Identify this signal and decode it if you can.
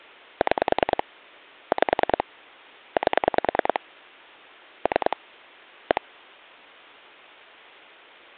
Pulse dialling, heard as clicks on a phone line, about 10 pulses a second. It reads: 6 5 8 3 1